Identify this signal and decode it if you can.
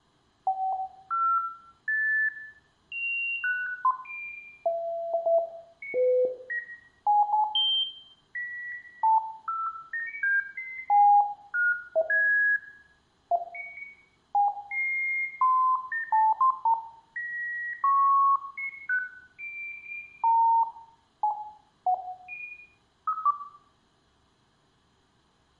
Electronic bleeps of random pitch and length, with room echo. There is no code.